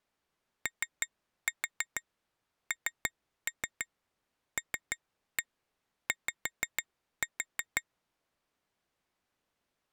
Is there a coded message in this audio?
Yes: tap code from 0.7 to 7.8 s, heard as taps on glass, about 6 knocks a second. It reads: ONLY